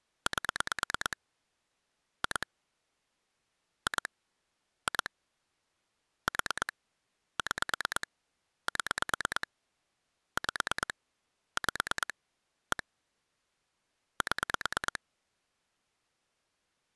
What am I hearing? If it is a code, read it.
Pulse dialling, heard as clicks on a phone line, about 9 pulses a second. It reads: 8 2 2 2 4 6 7 5 5 1 7